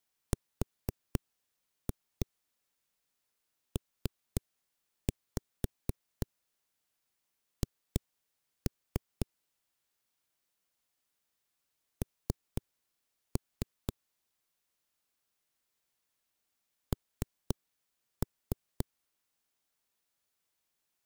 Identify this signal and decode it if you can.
Tap code, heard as knocks on a wall, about 4 knocks a second. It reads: RPH N N